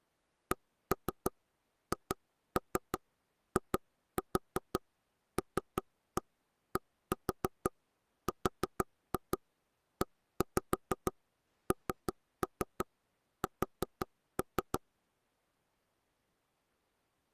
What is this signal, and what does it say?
Tap code, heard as knocks on wood, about 5 knocks a second. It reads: CHILDRENS